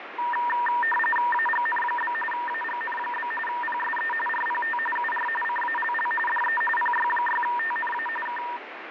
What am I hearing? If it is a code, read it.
RTTY (45.45 baud, 850 Hz shift), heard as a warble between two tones, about 1390 Hz centre, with radio static and fading. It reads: AGN? AGN? PSE RPT UR CALL DE PY6TNA K